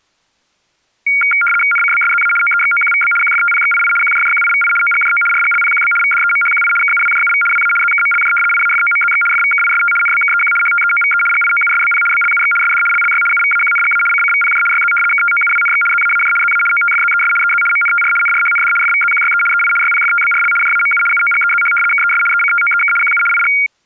RTTY (75 baud, 850 Hz shift), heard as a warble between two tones, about 1800 Hz centre. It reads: NCBSZA OEXOQVB QFTPXII QJJQIVI OGJO RGLPQB VDEMHQI KUWJUV WA ZKMLJ IAFOMZX FVKIST NBKEQ HTEOVE GIOUSBP BLUX SD LLY UVAQNGA CCVPJ YZ KTOUWNX ZAAJ ZA OTFZES EZ MNTR NRHND FVZQYE EI YPFTBRL JAMU UOGEZH KES ECTOEK QU IG